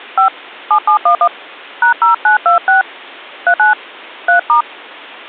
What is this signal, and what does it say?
DTMF, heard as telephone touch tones, dialled by hand, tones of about 100 ms. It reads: 5 7711 #0926 39 3*